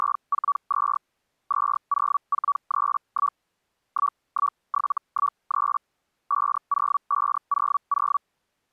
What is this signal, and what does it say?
Hellschreiber (Feld-Hell, 122.5 baud), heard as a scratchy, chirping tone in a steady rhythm, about 1140 Hz. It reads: … 20431 11713 50500